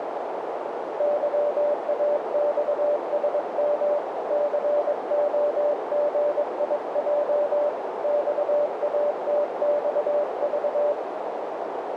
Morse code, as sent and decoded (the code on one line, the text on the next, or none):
-.-- .- -..- ... -- / -.-. --- --. .. .--- / -..- .- - -..- ...-
YAXSM COGIJ XATXV